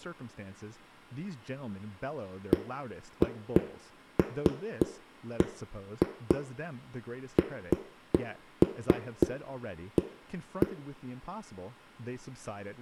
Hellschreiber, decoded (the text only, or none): none